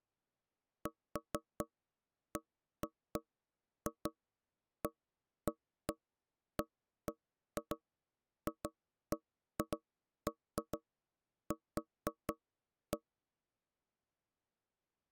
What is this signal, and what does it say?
Irregular knocks on wood. There is no code.